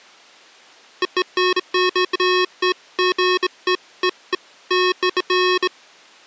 Beeps of irregular length. There is no code.